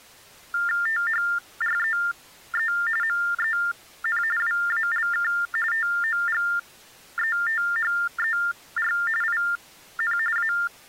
TTY/TDD text telephone tones (45.45 baud Baudot), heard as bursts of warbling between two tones, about 400 Hz shift, 1600 Hz centre. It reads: THREE MEN WALK TOGETHER IN A